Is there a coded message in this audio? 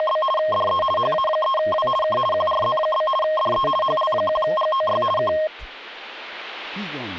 Yes: RTTY (50 baud, 450 Hz shift) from 0.0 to 5.5 s, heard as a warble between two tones, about 850 Hz centre. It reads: … DE HA3W K QRZ? DE HL1GOY K